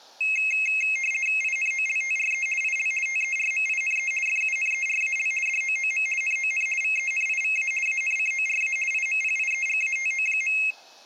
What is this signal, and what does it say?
RTTY (50 baud, 450 Hz shift), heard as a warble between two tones, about 2350 Hz centre. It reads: INOLTRE IL TERMINE FUNERAL DOOM NON VENIVA ANCORA IMPIEGATO.